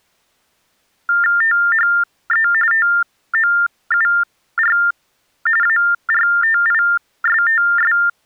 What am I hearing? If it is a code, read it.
TTY/TDD text telephone tones (45.45 baud Baudot), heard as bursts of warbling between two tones, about 400 Hz shift, 1600 Hz centre. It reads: THE TOUR ARTISTS